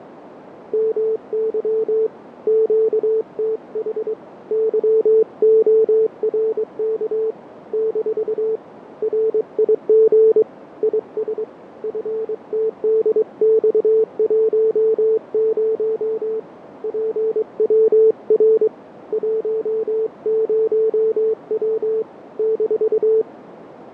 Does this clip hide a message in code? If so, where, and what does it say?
Yes: Morse code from 0.7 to 23.3 s, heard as a keyed tone, hand-sent with a straight key, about 23 wpm, 440 Hz, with radio static, fading and a narrow filter. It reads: MY QTH YORK - RIG IS FTDX10 PWR 10W -